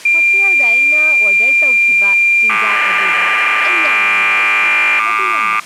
Cassette data (Kansas City type), 1200 baud, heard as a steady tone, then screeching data, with speech in Manipuri.